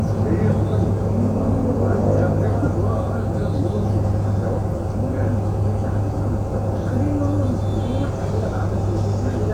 The noise inside a bus. There is no code.